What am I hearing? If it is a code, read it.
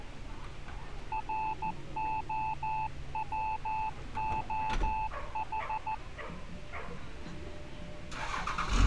Morse code, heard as a keyed tone, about 14 wpm, 870 Hz, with street noise. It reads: ROWOH